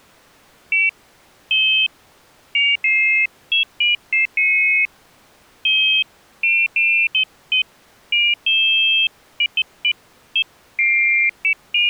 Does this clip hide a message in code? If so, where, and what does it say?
No, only pairs of high tones at irregular times.